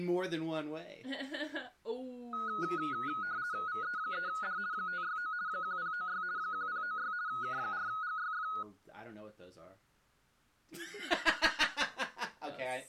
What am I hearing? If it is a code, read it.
RTTY (50 baud, 170 Hz shift), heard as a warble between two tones, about 1360 Hz centre. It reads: VE3D 569 1096 1096 K4GYF